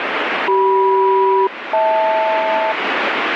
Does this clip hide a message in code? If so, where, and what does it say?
Yes: aircraft SELCAL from 0.5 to 2.7 s, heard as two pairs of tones, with heavy radio static. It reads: CM-HL